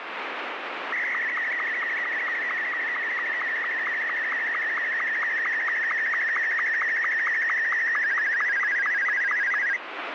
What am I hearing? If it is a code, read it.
SSTV (slow-scan television), Martin M2, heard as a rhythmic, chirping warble, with radio static.